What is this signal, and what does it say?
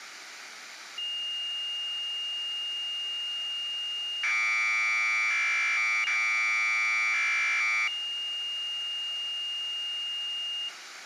Commodore tape loading (standard loader), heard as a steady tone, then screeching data, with tape hiss.